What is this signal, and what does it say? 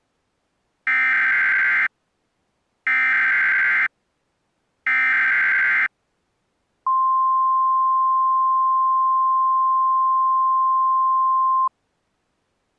Emergency Alert System (SAME) tones (header bursts, then the 1050 Hz attention tone), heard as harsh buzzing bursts, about 520.83 baud.